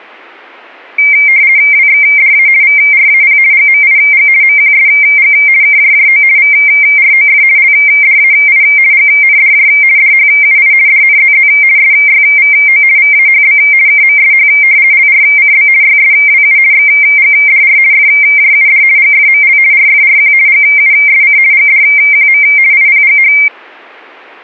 RTTY (50 baud, 170 Hz shift), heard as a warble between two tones, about 2200 Hz centre. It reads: WXDA VRAP GMIG MQSG KJJO VROF LDAI GNDJ DHUI DNZZ SYVO VAHB KMSH LRCB YSWU XGDR FJUD GFML RFRQ GUSC GDQM IPGH